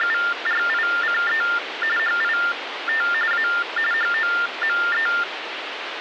TTY/TDD text telephone tones (45.45 baud Baudot), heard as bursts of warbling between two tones, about 400 Hz shift, 1600 Hz centre, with phone line noise. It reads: … HIT A HOME